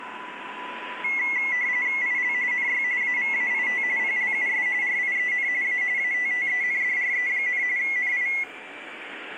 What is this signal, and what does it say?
RTTY (45.45 baud, 170 Hz shift), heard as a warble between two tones, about 2050 Hz centre, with the noise of a subway station. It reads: IL NY AVAIT PLUS RIEN A ATTENDRE, NI